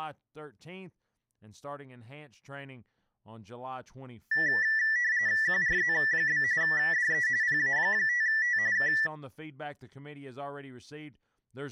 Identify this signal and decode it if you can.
RTTY (45.45 baud, 170 Hz shift), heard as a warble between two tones, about 1850 Hz centre, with speech in English. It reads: QRZ? DE PA5T K